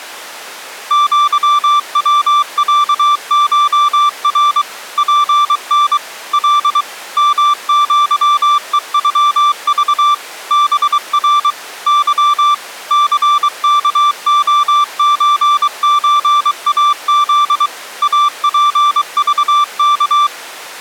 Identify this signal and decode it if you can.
Morse code (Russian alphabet), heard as a keyed tone, machine-sent, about 23 wpm, 1170 Hz. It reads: ЪВЯШР ПН Л МЪЕЮЖ БР Ы ЦКОЧЧАЗ АПЖК